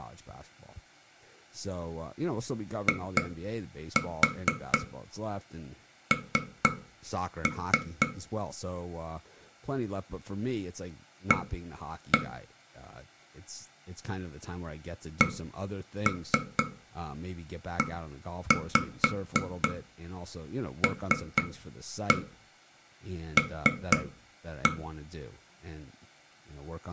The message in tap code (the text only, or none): IN A CELL